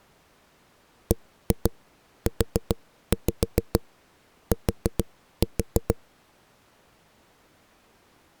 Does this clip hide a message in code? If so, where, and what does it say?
Yes: tap code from 1.1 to 6.0 s, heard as knocks on a wall, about 7 knocks a second. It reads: BUT